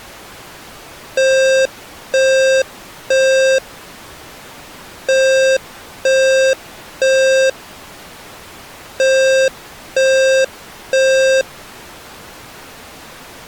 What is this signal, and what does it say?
Alarm pattern, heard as an alarm's beeps, played three times, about 530 Hz. Temporal three. Smoke or fire, evacuate.